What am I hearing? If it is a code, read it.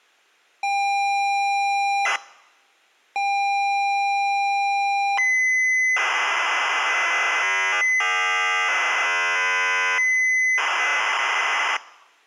ZX Spectrum tape loading, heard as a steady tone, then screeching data.